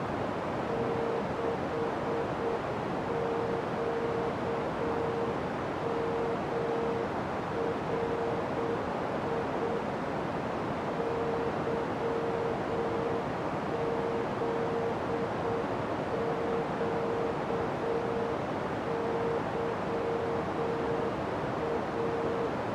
Morse code, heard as a keyed tone, machine-sent, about 7 wpm, 460 Hz, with heavy radio static and a narrow filter. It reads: 6QMRI YZQYA